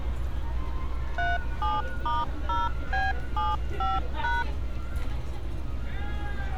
DTMF, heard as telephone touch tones, dialled by machine, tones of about 190 ms, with street noise. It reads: 37*0B75#